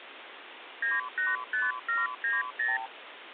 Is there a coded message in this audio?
Yes: multi-frequency trunk signalling (R2, with the far end's replies) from 0.8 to 2.9 s, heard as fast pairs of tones, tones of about 180 ms, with phone line noise. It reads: 985790